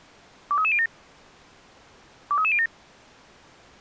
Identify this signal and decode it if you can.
Five-tone selective call (ZVEI), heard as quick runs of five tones, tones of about 70 ms. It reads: 23307 23307